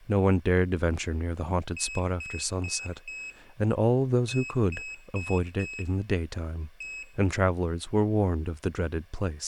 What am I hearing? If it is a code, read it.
Beep code, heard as a piezo beeper, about 2550 Hz, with room echo and speech in English. 4-4-1. In Phoenix BIOS tables: serial port failure.